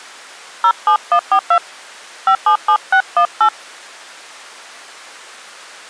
DTMF, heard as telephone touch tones, dialled by hand, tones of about 80 ms. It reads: 07142 577618